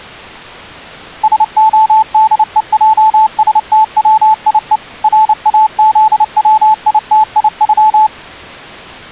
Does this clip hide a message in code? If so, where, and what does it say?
Yes: Morse code (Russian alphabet) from 1.2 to 8.1 s, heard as a keyed tone, machine-sent, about 29 wpm, 870 Hz. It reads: СОДЕЙСТВИЕ РАЗВИТИЮ